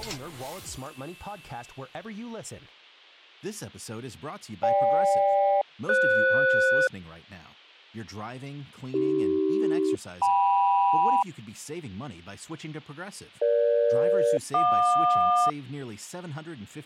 Aircraft SELCAL, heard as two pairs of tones. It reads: GK-FS AC-KM EG-JQ